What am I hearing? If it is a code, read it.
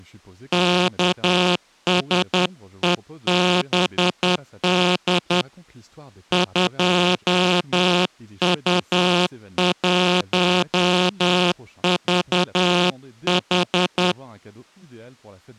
Morse code, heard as a buzzer, hand-sent with a straight key, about 10 wpm, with speech in French. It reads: KSEBD 2U1VH